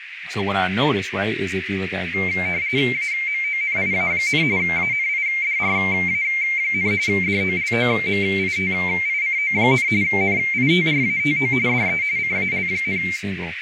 RTTY (45.45 baud, 170 Hz shift), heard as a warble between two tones, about 2200 Hz centre, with radio static, a narrow filter and speech in English. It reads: AMONIA, ANIDRA, DOLOMITICO, NITRATO DE CAL,